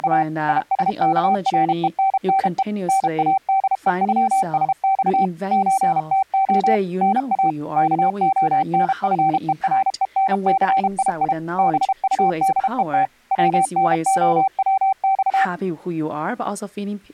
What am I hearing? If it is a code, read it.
Morse code (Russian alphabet), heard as a keyed tone, machine-sent, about 32 wpm, 770 Hz, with speech in English. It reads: … ИСКРЕННЕ НАДЕЮСЬ ЧТО НА КОНФЕРЕНЦИИ БУДЕТ ВНОВЬ